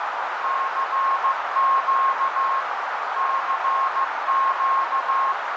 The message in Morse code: CQ CQ

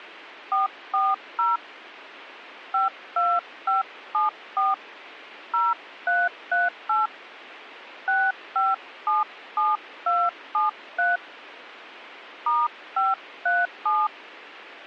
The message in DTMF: 440 52574 0338 6577273 *537

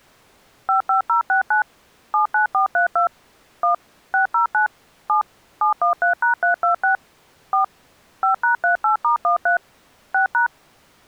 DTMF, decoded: 55069 79432 1 609 7 713#326 4 5#38*13 6#

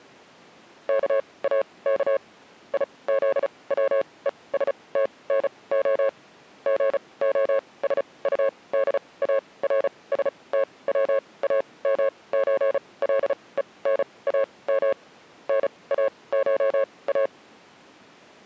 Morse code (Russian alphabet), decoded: КАК ИЗВЕСТНО ГОСУДАРСТВАМЧЛЕНАМ НАША

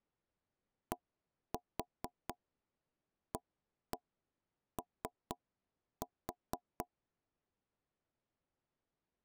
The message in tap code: DAO

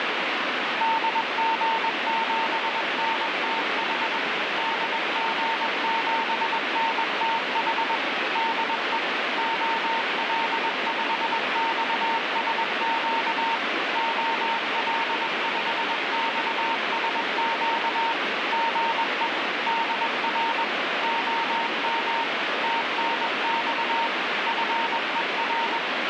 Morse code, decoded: DG7NTH DG7NTH DE OL5XSQ OL5XSQ GE DR OM TNX FER

